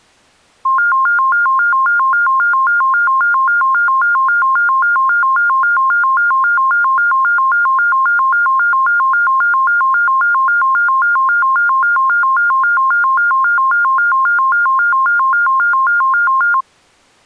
A tone that alternates evenly between two pitches. There is no code.